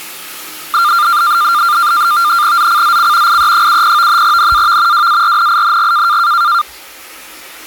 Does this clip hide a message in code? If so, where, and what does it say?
Yes: NAVTEX (SITOR-B), 100 baud, 170 Hz shift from 0.7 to 6.6 s, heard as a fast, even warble, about 1290 Hz centre, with the noise of a restroom. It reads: ZCZC IE70 NAV WARNING